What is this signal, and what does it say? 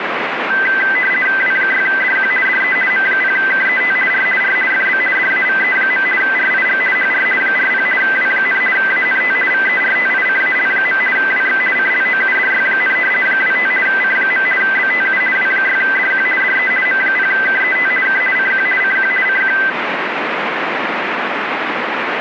RTTY (50 baud, 450 Hz shift), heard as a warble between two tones, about 1800 Hz centre, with radio static. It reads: W6DQ DE M0KET R R FB DAVE. RIG HR 40 W, ANT VERTICAL. WX CLOUDY, 25 C. BTU W6DQ DE M0KET K CQ CQ CQ